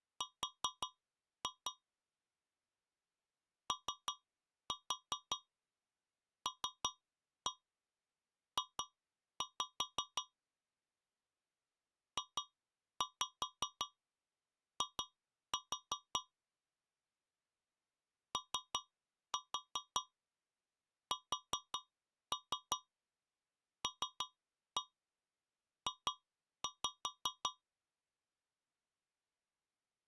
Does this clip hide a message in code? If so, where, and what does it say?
Yes: tap code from 0.2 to 27.6 s, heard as taps on a metal pipe, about 5 knocks a second. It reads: R OLJ JI OSLJ